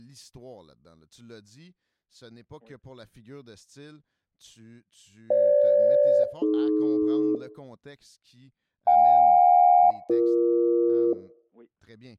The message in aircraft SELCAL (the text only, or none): FG-AD JK-BE